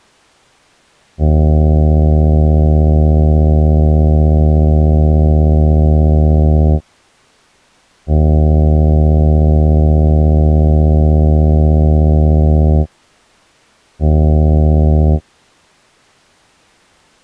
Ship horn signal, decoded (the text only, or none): 2 long, 1 short